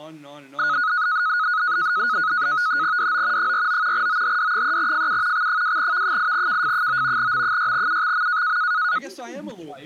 NAVTEX (SITOR-B), 100 baud, 170 Hz shift, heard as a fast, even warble, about 1360 Hz centre, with speech in English. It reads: DO 49 OHD3FU X2V8KF9 M6UXM